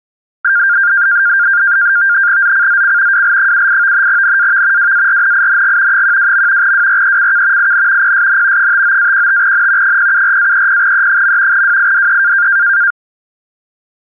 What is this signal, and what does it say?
NAVTEX (SITOR-B), 100 baud, 170 Hz shift, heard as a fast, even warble, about 1500 Hz centre. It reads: ZCZC WL78 NAV WARNING 12. WRECK IN PSN 59-15N 074-30E. WIDE